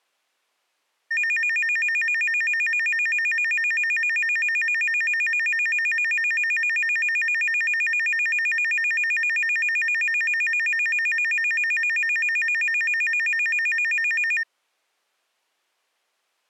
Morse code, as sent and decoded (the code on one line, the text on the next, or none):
none